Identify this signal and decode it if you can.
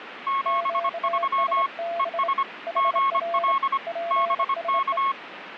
Morse code, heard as two keyed tones, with radio static. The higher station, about 25 wpm, 1090 Hz: 73 ES GL BK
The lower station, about 26 wpm, 680 Hz: QSB HR PSE